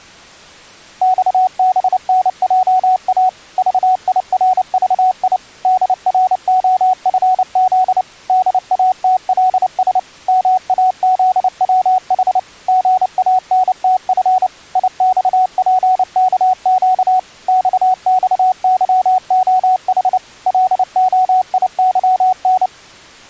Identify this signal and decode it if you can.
Morse code, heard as a keyed tone, machine-sent, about 29 wpm, 740 Hz. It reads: XBNJA VIRVI DROFZ DATLS MAZWH GANTF IXPKQ XXYOH LOIYN